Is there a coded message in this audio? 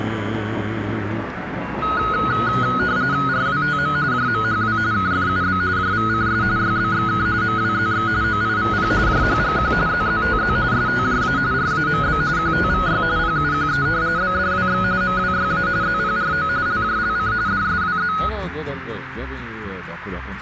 Yes: RTTY (45.45 baud, 170 Hz shift) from 1.8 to 18.3 s, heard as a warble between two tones, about 1360 Hz centre, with radio static and a narrow filter. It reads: RWTM JMHW KFUB JVCS YBXK MWZX OIVP JHGQ ZZTZ STJA RAMB QTVY PUQE BDWX MWYA ZPRO LJLC DSWZ